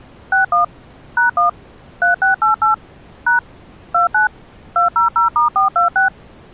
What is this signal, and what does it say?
DTMF, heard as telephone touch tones, dialled by machine, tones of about 130 ms. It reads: 61 #1 3688 # 29 200*426